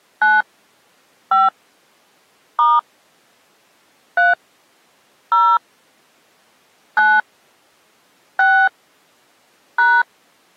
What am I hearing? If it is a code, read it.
DTMF, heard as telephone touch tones, dialled by hand, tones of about 240 ms. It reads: 9 5 * 3 0 9 6 #